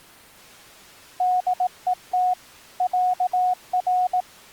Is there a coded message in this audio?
Yes: Morse code (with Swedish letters) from 1.1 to 4.3 s, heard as a keyed tone, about 18 wpm, 730 Hz. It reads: DET ÄR